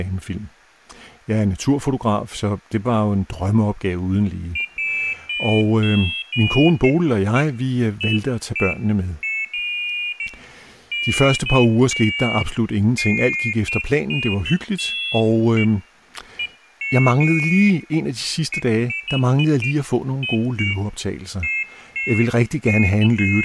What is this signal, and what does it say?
Pairs of high tones at irregular times, with room echo and speech in Danish. There is no code.